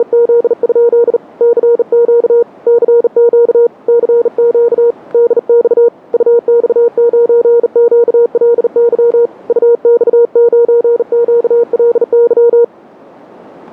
Morse code, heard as a keyed tone, hand-sent with a bug key, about 39 wpm, 470 Hz. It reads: … CQ CQ CQ DX UX9QLY UX9QLY